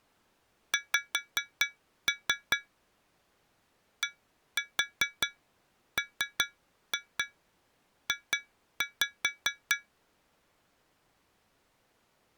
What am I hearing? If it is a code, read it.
Tap code, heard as taps on glass, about 4 knocks a second. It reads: X DMJ